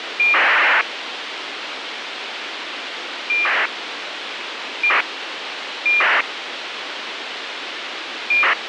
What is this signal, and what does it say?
ACARS aircraft data, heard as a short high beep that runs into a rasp, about 2400 baud, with radio hiss.